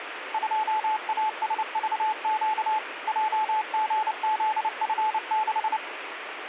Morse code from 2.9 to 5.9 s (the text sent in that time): JGZF6